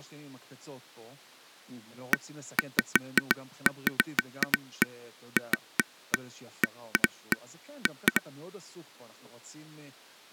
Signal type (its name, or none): none